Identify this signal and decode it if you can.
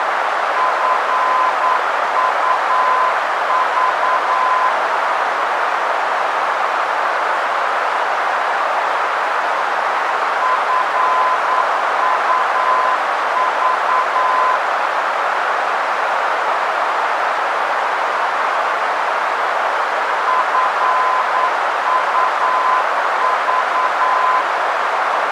Morse code, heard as a keyed tone, machine-sent, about 9 wpm, 1020 Hz, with heavy radio static and a narrow filter. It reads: FUV FUV FUV